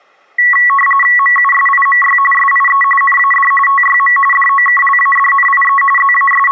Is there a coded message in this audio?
Yes: RTTY (45.45 baud, 850 Hz shift) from 0.4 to 6.5 s, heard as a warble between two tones, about 1550 Hz centre. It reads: MUSIMY SIE NAD TYM DOKLADNIE …